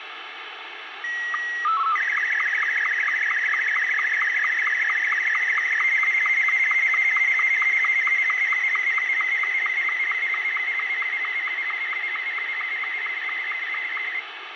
SSTV (slow-scan television), Martin M2, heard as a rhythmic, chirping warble, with radio static.